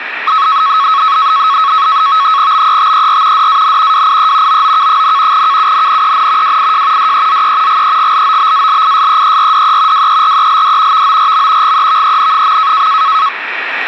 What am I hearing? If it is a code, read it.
NAVTEX (SITOR-B), 100 baud, 170 Hz shift, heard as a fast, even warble, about 1200 Hz centre, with radio static. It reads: BETER DAN WIE OOK, KUNNEN WIJ DEZE GEGLOBALISEERDE WERELD VORM GEVEN.